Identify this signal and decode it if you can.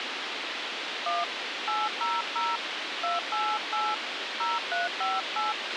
DTMF, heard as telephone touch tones, dialled by hand, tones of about 210 ms, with radio hiss and a squelch burst at the end. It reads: 1 800 288 0358